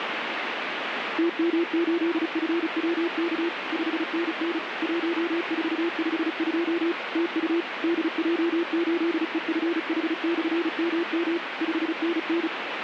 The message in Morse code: TM8FWK 5NN 1452 TU DJ8EFH/MM 5NN

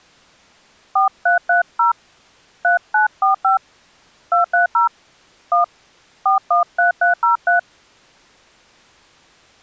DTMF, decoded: 4330 3945 230 1 413303

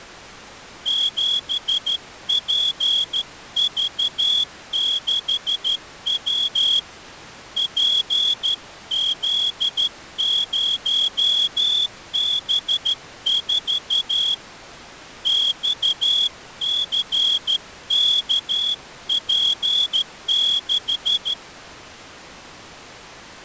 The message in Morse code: 7PV6W PZ0B4 XCKP6

